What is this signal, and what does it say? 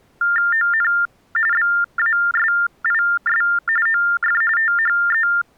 TTY/TDD text telephone tones (45.45 baud Baudot), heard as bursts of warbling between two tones, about 400 Hz shift, 1600 Hz centre. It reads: ON BASIS OF THE